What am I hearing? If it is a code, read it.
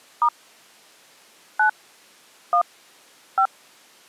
DTMF, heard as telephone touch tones, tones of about 80 ms. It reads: * 9 1 5